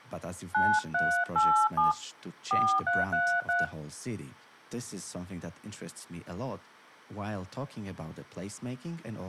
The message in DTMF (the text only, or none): 9387 4333